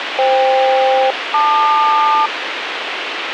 Aircraft SELCAL, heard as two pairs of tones, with radio hiss. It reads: FK-LQ